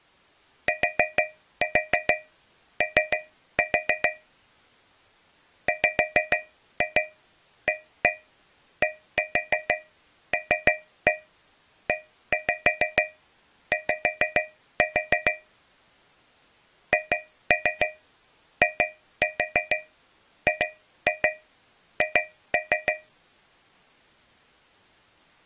Tap code, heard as taps on a metal pipe, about 6 knocks a second. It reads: TO WADLEY HIGH